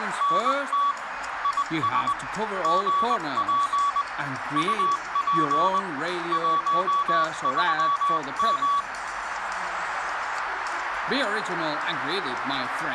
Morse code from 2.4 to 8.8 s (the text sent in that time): GP UP 13M